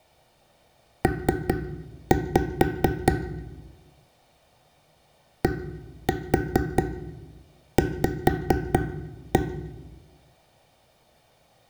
Tap code, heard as taps on a table, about 4 knocks a second, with room echo. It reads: P DV